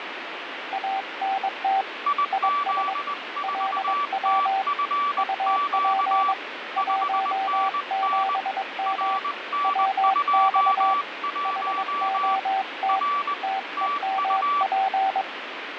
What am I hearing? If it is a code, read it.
Morse code, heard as two keyed tones, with radio static. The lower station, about 22 wpm, 770 Hz: ANT IS LW UP 17M WX HOT TEMP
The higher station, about 20 wpm, 1150 Hz: IZ4TFQ 5NN RN21 R TU